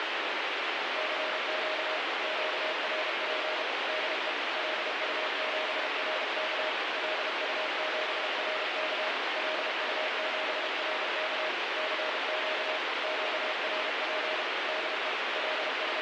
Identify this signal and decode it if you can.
Morse code, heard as a keyed tone, machine-sent, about 32 wpm, 620 Hz, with heavy radio static. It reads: CQ QRP DE LU7RK LU7RK LU7RK CQ QRP DE …